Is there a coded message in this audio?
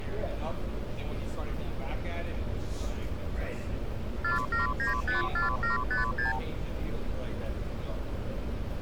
Yes: multi-frequency trunk signalling (R2, with the far end's replies) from 4.2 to 6.4 s, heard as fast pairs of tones, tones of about 140 ms, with hum and street noise. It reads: 47954756